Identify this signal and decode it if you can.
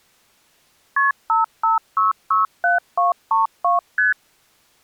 Multi-frequency trunk signalling (R1, as on North American trunks), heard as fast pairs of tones, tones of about 150 ms. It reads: KP 55667232 ST